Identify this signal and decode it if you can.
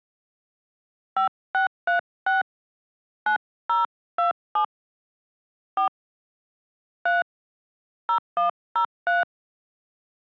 DTMF, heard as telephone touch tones, dialled by hand, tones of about 130 ms. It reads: 5636 9027 4 3 0103